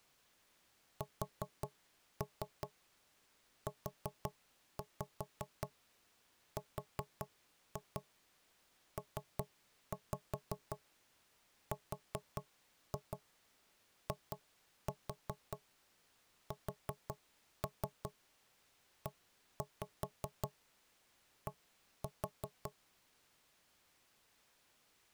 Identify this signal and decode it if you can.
Tap code, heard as knocks on wood, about 5 knocks a second. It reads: SURPRISED